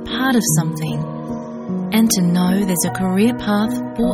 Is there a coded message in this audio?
No.